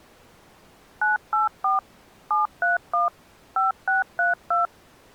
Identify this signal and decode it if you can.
DTMF, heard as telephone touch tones, dialled by machine, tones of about 150 ms. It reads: 984 731 5632